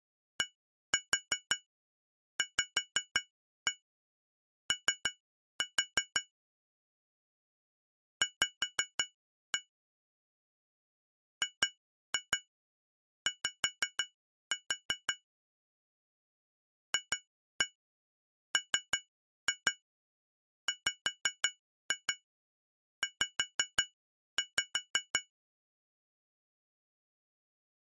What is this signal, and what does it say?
Tap code, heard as taps on glass, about 5 knocks a second. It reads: DVO V GY FMWZ